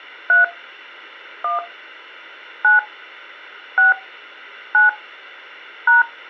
DTMF, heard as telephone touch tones, dialled by hand, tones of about 140 ms. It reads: 3 1 9 6 9 #